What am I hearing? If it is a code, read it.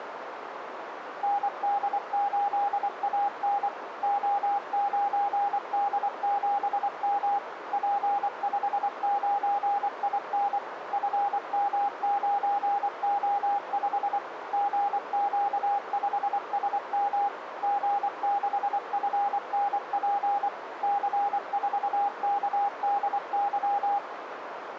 Morse code, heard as a keyed tone, machine-sent, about 24 wpm, 810 Hz, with radio static and a narrow filter. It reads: ND8AN O9D7M P59IN FM9O5 GQ5SM G6FNP C4KDY